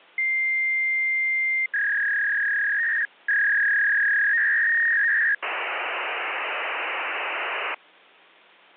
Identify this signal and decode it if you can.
Fax machine handshake, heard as a long tone, a warble and hiss.